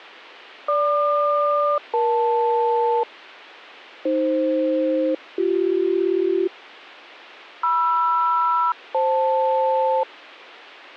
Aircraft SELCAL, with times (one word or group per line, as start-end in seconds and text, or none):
0.7-3.0 GQ-EL
4.1-6.5 AF-BC
7.6-10.0 MR-FL